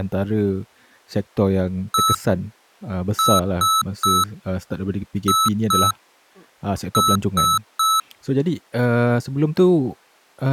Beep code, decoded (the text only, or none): 1-3-2-3